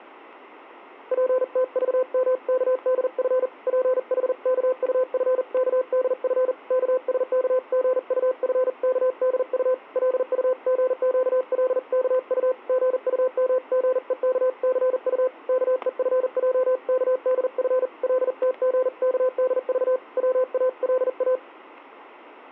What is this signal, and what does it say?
Morse code (Korean alphabet), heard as a keyed tone, hand-sent with a paddle, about 40 wpm, 510 Hz, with static crashes. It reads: 젊은 주인은 영신의 기색이 심상치 않은 것을 보고